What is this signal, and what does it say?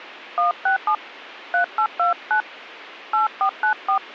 DTMF, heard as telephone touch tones, dialled by hand, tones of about 110 ms. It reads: 167 3829 8494